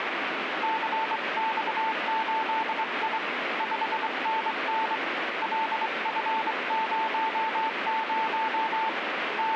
Morse code, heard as a keyed tone, hand-sent with a straight key, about 23 wpm, 890 Hz, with radio static. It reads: CX8I 5NN LF00 …